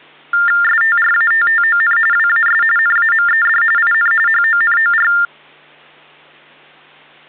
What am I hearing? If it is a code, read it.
TTY/TDD text telephone tones (45.45 baud Baudot), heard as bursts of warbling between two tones, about 400 Hz shift, 1600 Hz centre. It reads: STRATTON WAS NAMED IN HONOR